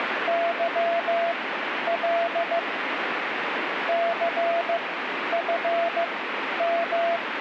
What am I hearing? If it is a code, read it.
Morse code, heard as a keyed tone, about 15 wpm, spaced as for 10 wpm, 680 Hz, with radio static. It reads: YL CFM